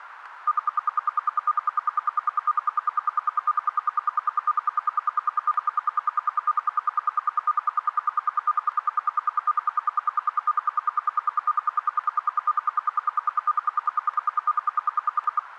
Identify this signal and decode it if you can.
Radio time signal (RWM, Moscow), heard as ten pulses a second, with radio static.